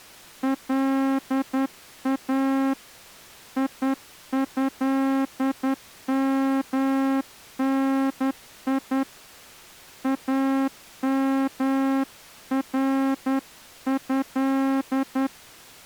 Morse code (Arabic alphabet), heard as a horn, hand-sent with a straight key, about 10 wpm. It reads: لا يهمني امره